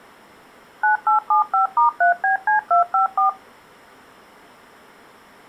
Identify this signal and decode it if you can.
DTMF, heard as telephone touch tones, dialled by machine, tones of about 120 ms. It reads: 9875*3BC254